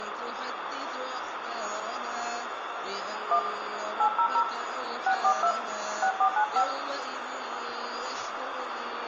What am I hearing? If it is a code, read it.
DTMF, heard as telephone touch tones, dialled by hand, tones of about 80 ms, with radio hiss and room echo. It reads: 1 800 642 6495